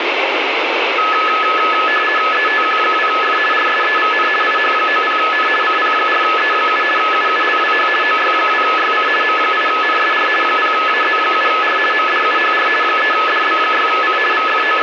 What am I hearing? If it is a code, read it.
RTTY (50 baud, 450 Hz shift), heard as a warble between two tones, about 1500 Hz centre, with radio static and room echo. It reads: ETQ2F RSEVN IH90N CP4E7 UULWH OY2YC M8NSR 0AZ7R MDUHR 3DB6C …